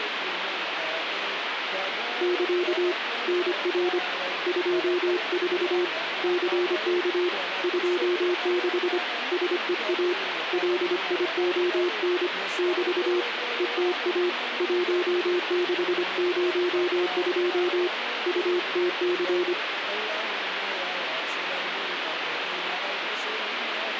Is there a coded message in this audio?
Yes: Morse code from 2.2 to 19.6 s, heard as a keyed tone, hand-sent with a paddle, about 25 wpm, 360 Hz, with radio static. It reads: <KA> NR 24 CK 26 SEA LION <BT> ETA 1602 UTC